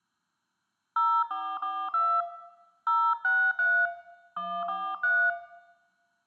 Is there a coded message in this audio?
Yes: DTMF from 1.0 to 5.3 s, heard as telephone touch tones, dialled by hand, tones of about 270 ms, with room echo. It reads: 0442 063 143